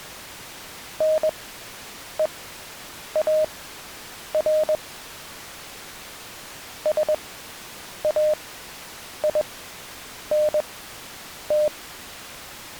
Morse code, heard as a keyed tone, machine-sent, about 21 wpm, spaced as for 8 wpm, 610 Hz. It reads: NEAR SAINT